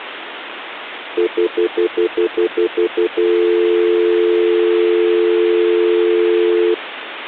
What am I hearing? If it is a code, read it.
Telephone call progress tone (North American plan), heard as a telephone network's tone, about 350, 440 Hz, 0.1 s on and 0.1 s off, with phone line noise. Stutter dial tone.